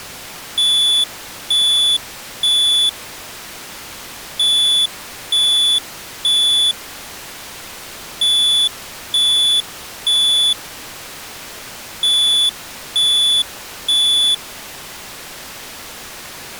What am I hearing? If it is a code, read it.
Alarm pattern, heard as an alarm's beeps, played four times, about 3450 Hz. Temporal three. Smoke or fire, evacuate.